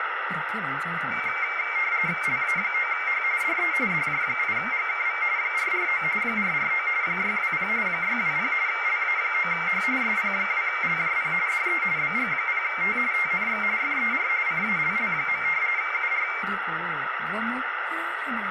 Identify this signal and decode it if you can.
RTTY (45.45 baud, 170 Hz shift), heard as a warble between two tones, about 2200 Hz centre, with radio static and speech in Korean. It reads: LA9H DE DJ8GKV 449 449 620 620 LA9H SP2LJP DE BG0T TNX FER CALL. UR